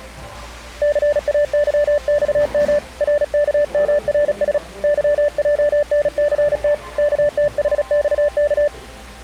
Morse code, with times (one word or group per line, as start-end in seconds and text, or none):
0.8-2.8 CAYXM
3.0-4.6 RKMRS
4.8-6.7 YJNCT
7.0-8.7 KTHXK